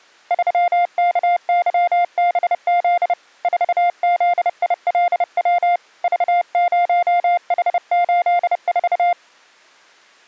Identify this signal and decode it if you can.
Morse code, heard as a keyed tone, hand-sent with a paddle, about 30 wpm, 700 Hz. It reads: 3KYBZ 4ZILW V0H84